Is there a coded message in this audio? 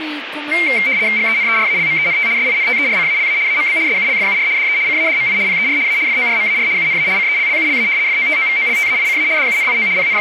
Yes: RTTY (75 baud, 170 Hz shift) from 0.5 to 10.2 s, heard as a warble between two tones, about 2200 Hz centre, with radio static and speech in Manipuri. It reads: GENERALMENT SINTERCALA AMB SULFUR DE CADMI PER A FORMAR UNA CELLULA FOTOVOLTAICA DUNIO …